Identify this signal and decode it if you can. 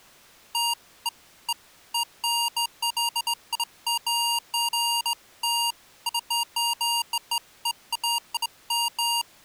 Beeps of irregular length. There is no code.